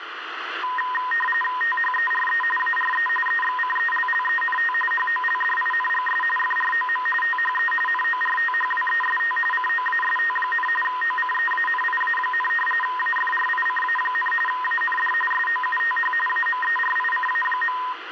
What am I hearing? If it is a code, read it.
RTTY (45.45 baud, 850 Hz shift), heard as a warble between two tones, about 1430 Hz centre, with radio static. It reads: THERE ARE EXCELLENT HOLDINGS FROM THE NORTHWEST COAST, OCEANIA, AFRICA, AND SOUTH AMERICA.